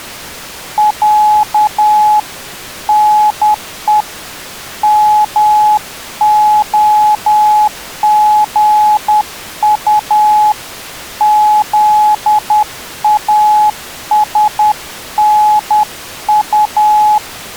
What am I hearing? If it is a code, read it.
Morse code (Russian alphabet), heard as a keyed tone, hand-sent with a paddle, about 10 wpm, 850 Hz. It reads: Я НЕ МОГУ …